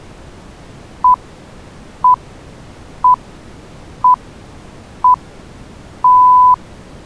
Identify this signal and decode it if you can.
Radio time signal (six pips, as the Greenwich Time Signal), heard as pips.